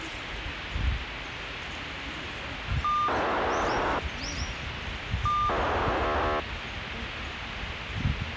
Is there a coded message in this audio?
Yes: POCSAG pager data (2400 baud) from 2.8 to 6.4 s, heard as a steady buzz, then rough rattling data, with radio hiss and the noise of a residential street.